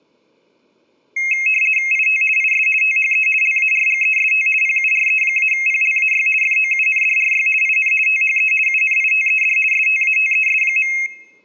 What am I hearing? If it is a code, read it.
RTTY (50 baud, 450 Hz shift), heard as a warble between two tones, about 2350 Hz centre. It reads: IT IS THE LARGEST PURE-PLAY FOUNDRY IN THE UNITED STATES.